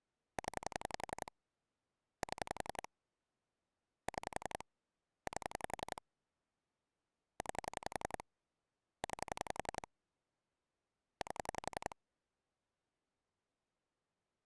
Pulse dialling, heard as clicks on a phone line, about 11 pulses a second. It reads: 0 7 6 8 9 9 8